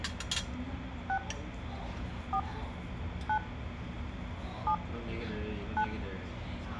DTMF, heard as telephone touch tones, dialled by hand, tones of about 80 ms, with phone line noise, room echo and the noise of a restaurant. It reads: 6 4 9 7 9